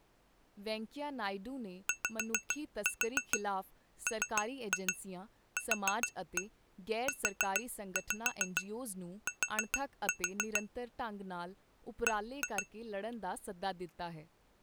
Tap code, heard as taps on glass, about 6 knocks a second, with speech in Punjabi. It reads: YMQUT B